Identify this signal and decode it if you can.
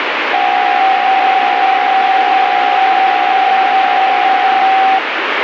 PSK63 (62.5 baud), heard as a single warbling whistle, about 770 Hz, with radio static.